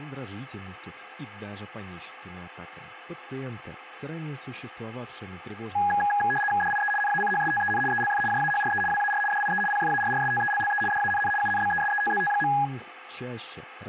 RTTY (75 baud, 850 Hz shift), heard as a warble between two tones, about 1240 Hz centre, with radio static, a steady whistle near 510 Hz and speech in Russian. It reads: DIE NACHSTEN ELF JAHRE WAR DIE PFARRSTELLE DANN UNBESETZT.